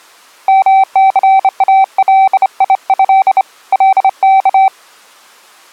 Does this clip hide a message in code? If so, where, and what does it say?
Yes: Morse code (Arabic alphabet) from 0.4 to 4.7 s, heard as a keyed tone, hand-sent with a straight key, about 28 wpm, 770 Hz. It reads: مثاليه لك